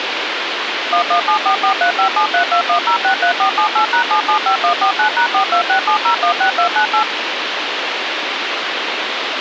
DTMF, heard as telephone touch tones, dialled by machine, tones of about 100 ms, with radio hiss. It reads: 11744357321063478#775149#4267016298